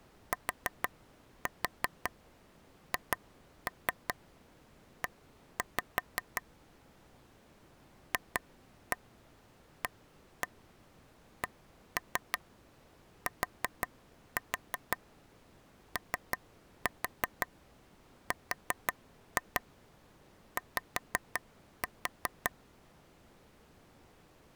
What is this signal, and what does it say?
Tap code, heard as taps on a table, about 5 knocks a second. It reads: THE FACTORY